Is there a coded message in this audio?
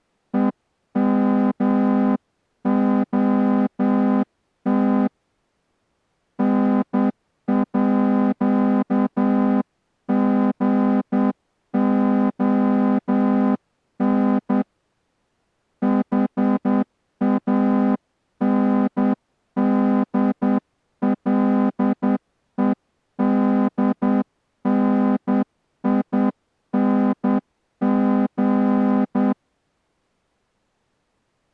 Yes: Morse code (with Swedish letters) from 0.3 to 29.4 s, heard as a horn, hand-sent with a straight key, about 9 wpm. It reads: EMOT NÅGON HANDLEDNING